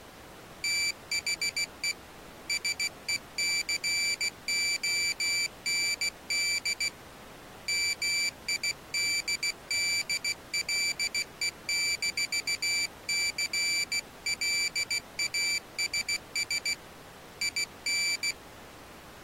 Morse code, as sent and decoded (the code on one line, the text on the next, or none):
- .... . / ... . -.-. --- -. -.. / -- .. -.. -.. .-.. . -....- -.-. .-.. .- ... ... / .. -.
THE SECOND MIDDLE-CLASS IN